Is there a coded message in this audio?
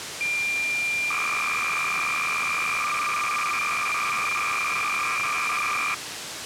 Yes: cassette data (Kansas City type), 300 baud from 0.2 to 5.9 s, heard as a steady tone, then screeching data, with tape hiss.